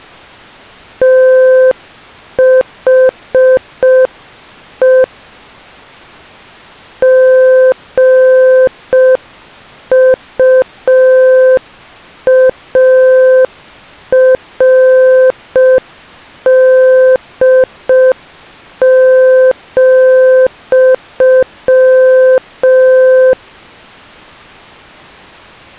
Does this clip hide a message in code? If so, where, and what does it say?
Yes: Morse code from 1.0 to 23.4 s, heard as a keyed tone, hand-sent with a paddle, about 5 wpm, 520 Hz. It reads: THE GUARD,